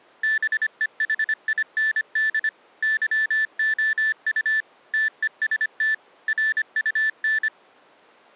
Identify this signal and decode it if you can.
Morse code, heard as electronic beeps, machine-sent, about 25 wpm, 1750 Hz. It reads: BEHIND YOU TEST RUN